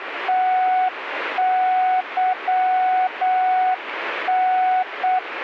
Morse code, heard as a keyed tone, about 8 wpm, 740 Hz, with radio static. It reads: TYN